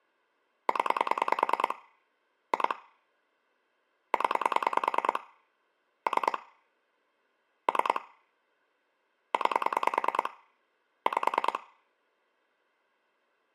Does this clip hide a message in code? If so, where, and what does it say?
Yes: pulse dialling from 0.7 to 11.6 s, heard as clicks on a phone line, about 10 pulses a second, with room echo. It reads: 0 2 0 3 3 9 5